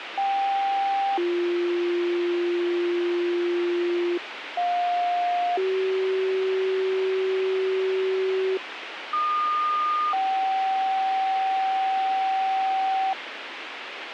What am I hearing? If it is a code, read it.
Two-tone page, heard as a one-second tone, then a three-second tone, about 790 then 350 Hz, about 710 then 380 Hz, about 1220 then 770 Hz, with radio hiss.